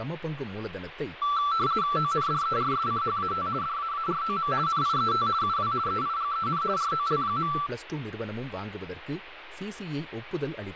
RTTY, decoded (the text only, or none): ONDERSCHAT DAAROM NIET UW EIGEN ROL.